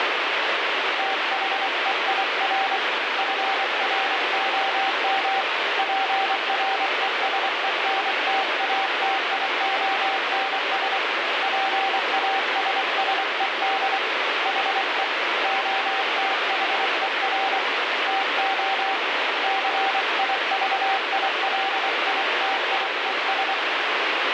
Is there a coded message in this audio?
Yes: Morse code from 0.9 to 23.6 s, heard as a keyed tone, hand-sent with a paddle, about 24 wpm, 780 Hz, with heavy radio static. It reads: THEIR FROM PRESENTATIONS PASSED HE OTHER TO CIVILITIES